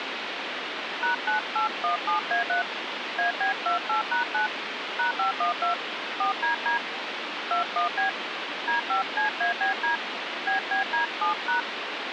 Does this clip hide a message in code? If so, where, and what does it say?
Yes: DTMF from 1.0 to 11.6 s, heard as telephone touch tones, dialled by hand, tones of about 120 ms, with phone line noise. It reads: #9817A3 AB28#9 #512 4DD 21B D5CABD BBD7#